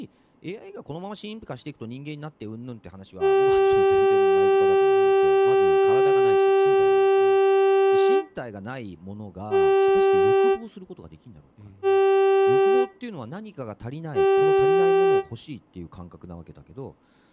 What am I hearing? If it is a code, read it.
Ship horn signal, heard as a ship's horn, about 390 Hz, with speech in Japanese. 1 long, 3 short. At sea: a vessel under tow in fog.